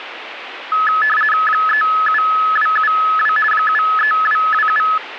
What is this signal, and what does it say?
RTTY (50 baud, 450 Hz shift), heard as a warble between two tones, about 1500 Hz centre, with radio static. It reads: 37272 73227